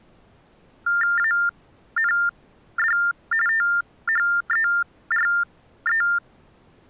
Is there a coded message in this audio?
Yes: TTY/TDD text telephone tones (45.45 baud Baudot) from 0.9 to 6.2 s, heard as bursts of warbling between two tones, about 400 Hz shift, 1600 Hz centre. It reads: AND THERE